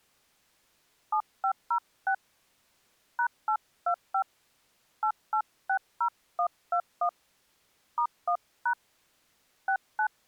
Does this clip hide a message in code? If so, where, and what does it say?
Yes: DTMF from 1.1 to 10.1 s, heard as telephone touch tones, dialled by hand, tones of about 80 ms. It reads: 7506 #825 8860121 *1# 69